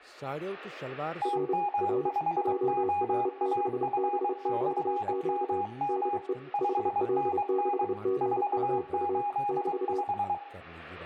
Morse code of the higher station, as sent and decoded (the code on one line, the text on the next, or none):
- -- ..... --- .- ..-. -..-. -- -- / ..... -. -. / ....- ---.. .....
TM5OAF/MM 5NN 485